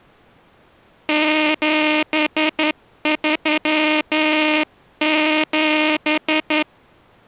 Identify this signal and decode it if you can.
Morse code, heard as a buzzer, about 11 wpm. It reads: 737